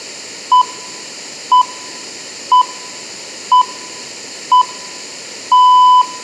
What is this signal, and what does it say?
Radio time signal (six pips, as the Greenwich Time Signal), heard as pips, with room echo.